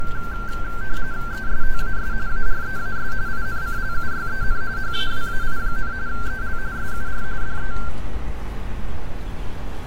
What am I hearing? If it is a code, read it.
RTTY (45.45 baud, 170 Hz shift), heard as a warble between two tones, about 1460 Hz centre, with radio static and street noise. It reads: ESTAS AREAS INCLUYEN HAWAI, EL SUR DE